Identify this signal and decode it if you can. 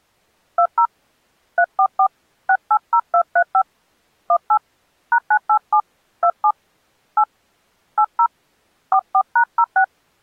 DTMF, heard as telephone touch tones, dialled by hand, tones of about 70 ms. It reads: 20 344 680235 18 #987 27 8 80 44#06